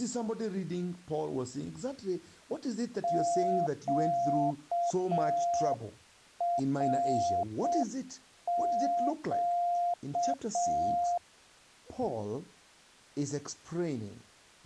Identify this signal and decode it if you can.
Morse code, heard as a keyed tone, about 6 wpm, 700 Hz. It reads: QRQ